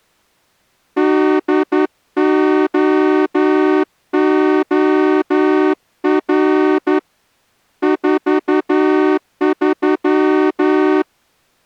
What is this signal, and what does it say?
Morse code, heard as a horn, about 11 wpm. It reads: DOOR 43